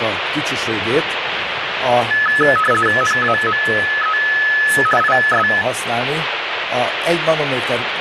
RTTY (50 baud, 450 Hz shift), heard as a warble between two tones, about 1500 Hz centre, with radio static. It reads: NAME IS